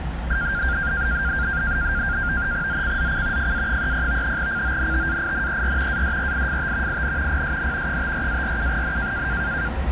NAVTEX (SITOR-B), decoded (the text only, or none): ZCZC FA30 CONTAINER ADRIFT IN PSN 54-47N